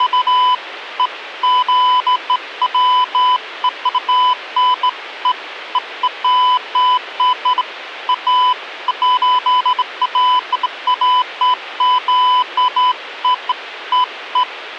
Beeps of irregular length, with radio hiss. There is no code.